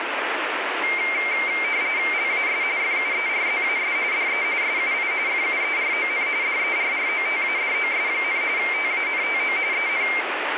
RTTY (45.45 baud, 170 Hz shift), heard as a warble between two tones, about 2200 Hz centre, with radio static. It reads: LAS FUERZAS DE SUI FUERON DERROTADOS, TANTO EN